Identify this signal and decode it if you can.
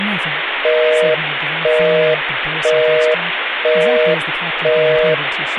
Telephone call progress tone (North American plan), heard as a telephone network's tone, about 480, 620 Hz, 0.5 s on and 0.5 s off, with phone line noise and speech in English. Busy tone.